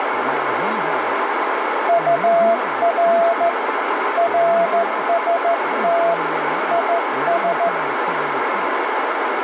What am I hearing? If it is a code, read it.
Morse code, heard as a keyed tone, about 14 wpm, 680 Hz, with heavy radio static and speech in English. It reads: UR RST IS